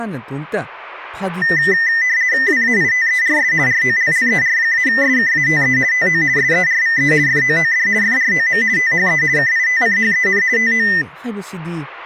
RTTY (50 baud, 170 Hz shift), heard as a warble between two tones, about 1900 Hz centre, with speech in Manipuri. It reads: WAITERS ROLLER-SKATE TO SERVE FOOD FROM THE KITCHEN TO